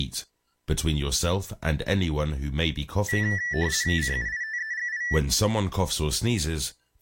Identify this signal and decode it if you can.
RTTY (50 baud, 170 Hz shift), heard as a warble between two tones, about 1850 Hz centre, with speech in English. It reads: CUITEGI